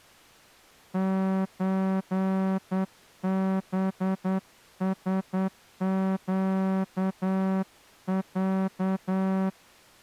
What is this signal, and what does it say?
Morse code (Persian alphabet), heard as a horn, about 9 wpm. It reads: چبسگص